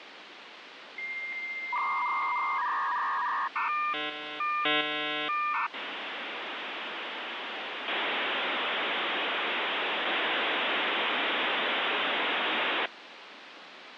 Dial-up modem handshake (V.34 or later), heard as a whistle, warbles, then hiss, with phone line noise.